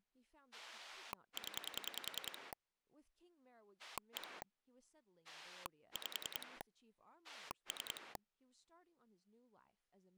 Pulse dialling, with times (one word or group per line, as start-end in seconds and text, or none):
0.5-2.5 0
3.8-4.4 1
5.2-6.6 5
7.2-8.2 3